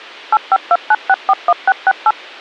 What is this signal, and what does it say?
DTMF, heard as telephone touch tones, dialled by machine, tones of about 50 ms. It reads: 8529641668